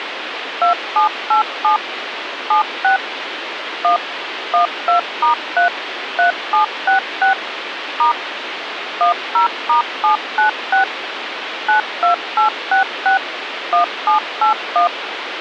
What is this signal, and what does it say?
DTMF, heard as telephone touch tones, dialled by machine, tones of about 120 ms, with phone line noise. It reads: 2787 76 1 12*3 3766 * 10*796 92866 1781